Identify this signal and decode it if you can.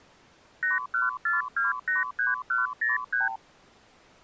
Multi-frequency trunk signalling (R2, with the far end's replies), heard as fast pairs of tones, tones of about 160 ms. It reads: 814283103